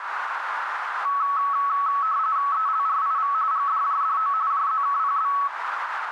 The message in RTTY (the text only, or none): ELRIV GDJDO JZKPB